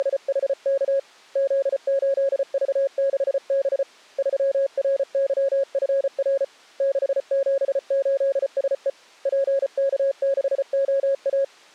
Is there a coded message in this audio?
Yes: Morse code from 0.0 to 11.5 s, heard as a keyed tone, hand-sent with a paddle, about 34 wpm, 550 Hz. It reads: … Z8V6B 3RYFR 678SE PK6OA